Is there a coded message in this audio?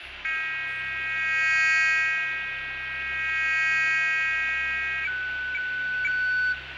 Yes: weather fax (radiofax), 120 lines a minute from 0.2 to 6.5 s, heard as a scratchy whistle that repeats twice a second, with radio static and fading.